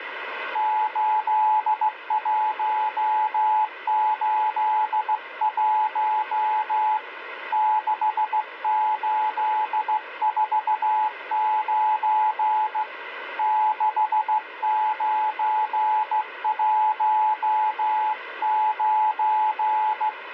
Morse code, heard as a keyed tone, hand-sent with a straight key, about 15 wpm, 860 Hz, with radio static. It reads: 8181 6849 6919